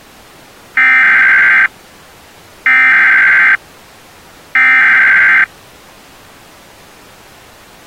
Emergency Alert System (SAME) tones (header bursts), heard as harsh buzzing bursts, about 520.83 baud.